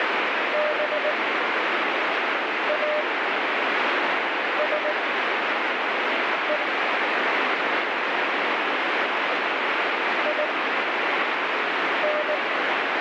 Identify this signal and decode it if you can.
Morse code, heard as a keyed tone, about 19 wpm, spaced as for 5 wpm, 600 Hz, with heavy radio static. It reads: BASE IN